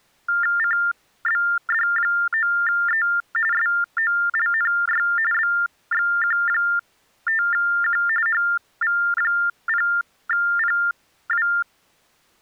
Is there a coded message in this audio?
Yes: TTY/TDD text telephone tones (45.45 baud Baudot) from 0.3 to 11.6 s, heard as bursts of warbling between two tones, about 400 Hz shift, 1600 Hz centre. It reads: CBD9E SOLNY BXQ5Q HV0PW